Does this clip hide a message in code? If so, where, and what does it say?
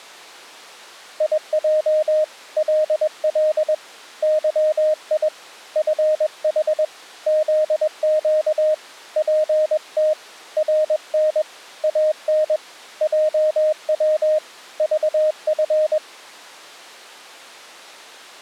Yes: Morse code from 1.1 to 16.0 s, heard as a keyed tone, hand-sent with a paddle, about 21 wpm, 620 Hz. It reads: IJ LL YI FH ZQ PT RN AN JW VF